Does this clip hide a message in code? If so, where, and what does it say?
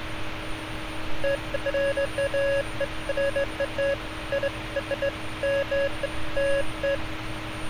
No, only beeps of irregular length, with street noise.